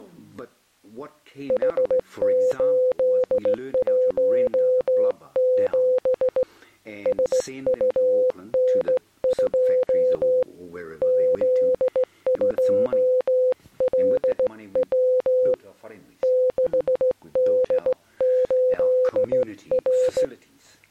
Morse code, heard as a keyed tone, hand-sent with a straight key, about 16 wpm, 510 Hz. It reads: H817 SUN2 Z2LW 6D8R